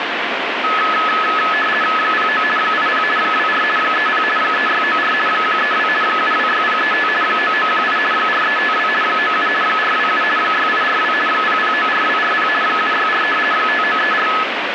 RTTY (50 baud, 450 Hz shift), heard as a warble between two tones, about 1500 Hz centre, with radio static. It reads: 09 80 24 30 3694 132 726035 9918 4352 97 427 6842 0094240 764 5934